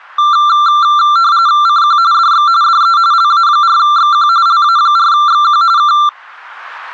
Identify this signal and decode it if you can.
RTTY (45.45 baud, 170 Hz shift), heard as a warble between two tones, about 1270 Hz centre. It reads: CQ DX DE LA4XQ LA4XQ K